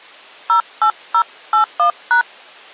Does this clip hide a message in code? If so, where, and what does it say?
Yes: DTMF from 0.5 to 2.2 s, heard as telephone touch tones, dialled by hand, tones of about 90 ms. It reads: 08081#